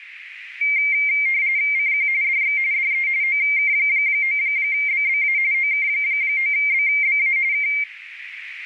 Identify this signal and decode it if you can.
RTTY (45.45 baud, 170 Hz shift), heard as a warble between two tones, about 2200 Hz centre, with radio static and a narrow filter. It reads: CQ DX DE OK9BBA OK9BBA K